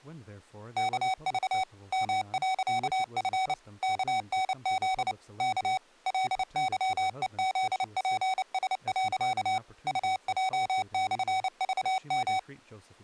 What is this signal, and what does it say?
Morse code, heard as electronic beeps, machine-sent, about 29 wpm, 760 Hz, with speech in English. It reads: KV M.F KNZ K LYEZPS. UJ/VM